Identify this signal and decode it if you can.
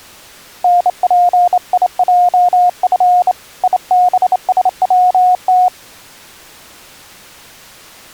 Morse code, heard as a keyed tone, hand-sent with a straight key, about 28 wpm, 720 Hz. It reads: NPIJF IBSWT